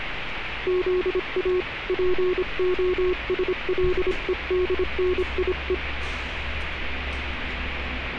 Morse code (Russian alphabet), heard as a keyed tone, hand-sent with a paddle, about 26 wpm, 360 Hz, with radio static and street noise. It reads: ЗА ПОСЛЕДНИЕ